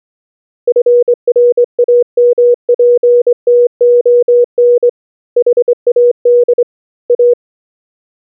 Morse code, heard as a keyed tone, hand-sent with a straight key, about 23 wpm, 480 Hz. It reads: FRAMPTON HAD A